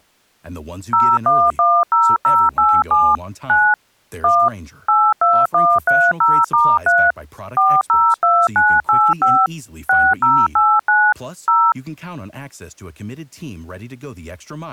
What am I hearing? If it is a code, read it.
DTMF, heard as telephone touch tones, dialled by machine, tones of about 240 ms, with speech in English. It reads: 0110087 9 1 82130*3 402985 6089 0